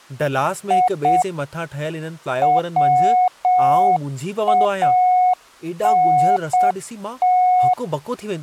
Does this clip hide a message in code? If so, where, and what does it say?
Yes: Morse code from 0.6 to 7.8 s, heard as a keyed tone, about 7 wpm, 730 Hz, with speech in Sindhi. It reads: I WANT